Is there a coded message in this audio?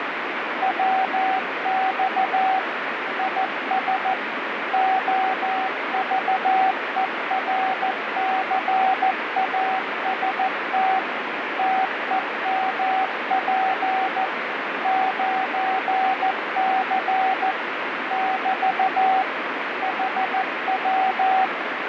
Yes: Morse code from 0.6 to 21.5 s, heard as a keyed tone, machine-sent, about 14 wpm, 760 Hz, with radio static. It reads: WX IS OVERCAST TEMP 9C <BT> HW